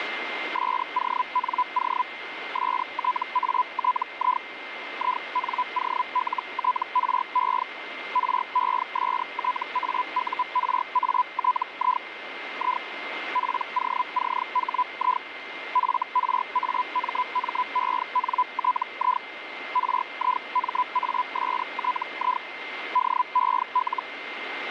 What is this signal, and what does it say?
Hellschreiber (Feld-Hell, 122.5 baud), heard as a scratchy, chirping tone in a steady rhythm, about 1000 Hz, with radio static and a steady whistle near 2090 Hz. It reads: SONO STATI INOLTRE RESTAURATI I POCHI FRAMMENTI RIMASTI DEL